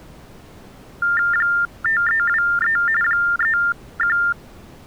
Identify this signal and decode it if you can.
TTY/TDD text telephone tones (45.45 baud Baudot), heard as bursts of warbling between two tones, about 400 Hz shift, 1600 Hz centre. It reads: 5323 31